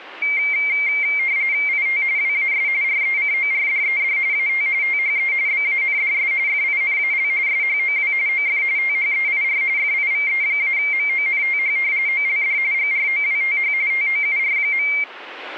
RTTY (45.45 baud, 170 Hz shift), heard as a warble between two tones, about 2200 Hz centre. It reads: IT WAS RECORDED AT THE BANDS FINAL SHOW OF THEIR FIVE-MONTH OLD GROWTH TOUR.